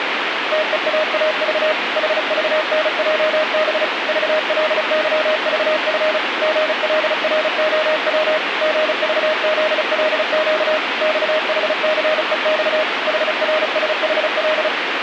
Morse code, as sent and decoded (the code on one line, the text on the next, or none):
- . .- .- ...- / .... ...- -. .--- -... / ...- .-.. -.-- ...- ..-. / --. .-.. .-. --- .-- / --. ...- --.. .-.. --.- / -..- .... -.-. . -..- / .... .-. ... .... .-..
TEAAV HVNJB VLYVF GLROW GVZLQ XHCEX HRSHL